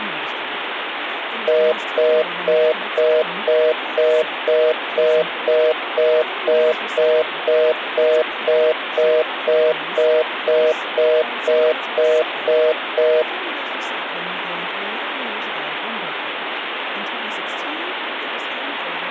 Telephone call progress tone (North American plan), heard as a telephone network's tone, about 480, 620 Hz, 0.25 s on and 0.25 s off, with phone line noise and speech in English. Congestion tone.